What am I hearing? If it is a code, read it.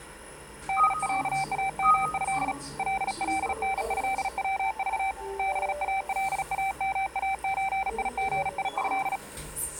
Morse code (Arabic alphabet), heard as a keyed tone, hand-sent with a bug key, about 36 wpm, 780 Hz, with the noise inside a lift. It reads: دعامه للنهوض بالامازيغيه